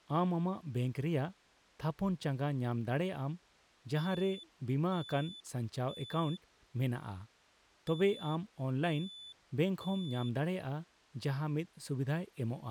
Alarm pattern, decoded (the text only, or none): temporal three